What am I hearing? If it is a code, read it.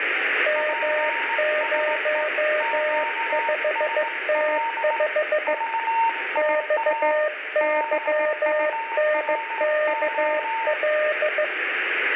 Morse code, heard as two keyed tones, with radio static and room echo. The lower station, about 15 wpm, 610 Hz: M05T5 XYNKL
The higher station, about 18 wpm, 920 Hz: PSE QSL VIA BURO